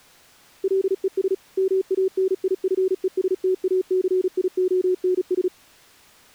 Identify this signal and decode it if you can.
Morse code, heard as a keyed tone, machine-sent, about 36 wpm, 380 Hz. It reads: LES MANIFESTACIONS